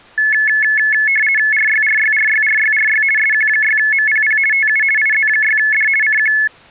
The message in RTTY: RYRYRYRYRY SQ6MPP TU IZ6D CQ

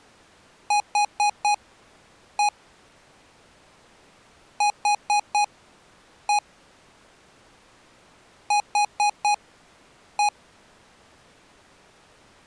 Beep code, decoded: 4-1

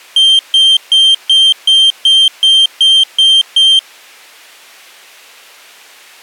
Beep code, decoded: 10 short

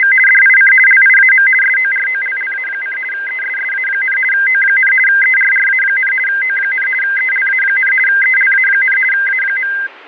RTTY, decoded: … DIC LIAM SOROLLA: ESSA, O, ERRA, O, ELA, ELA, A.

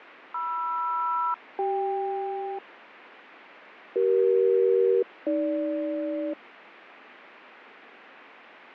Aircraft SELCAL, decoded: MR-CK CE-AG

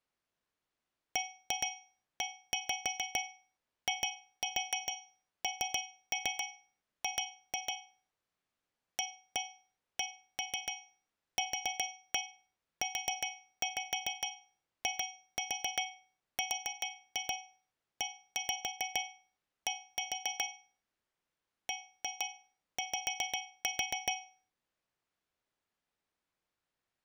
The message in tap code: BEING ACQUIRED BY

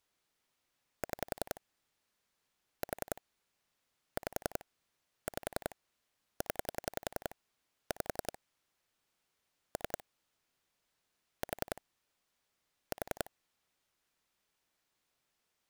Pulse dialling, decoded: 6 4 5 5 0 5 3 4 4

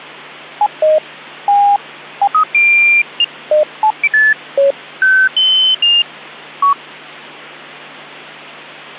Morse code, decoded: none

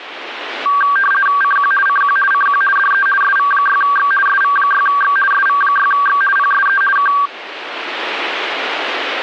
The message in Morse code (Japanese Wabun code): none

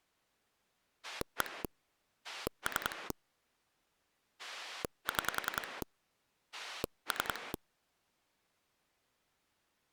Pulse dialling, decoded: 1 3 6 3

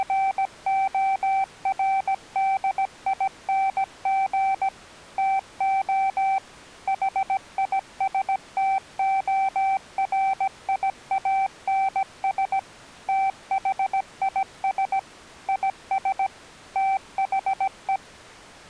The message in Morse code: … TO HISTORIANS THIS IS THE

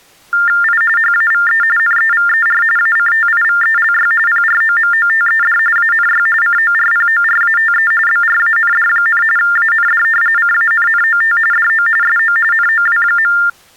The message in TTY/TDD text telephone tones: I HAVE NEVER ACTIVELY PROMOTED ANY CORPORATE BRAND, AND CANNOT DO SO NOW.

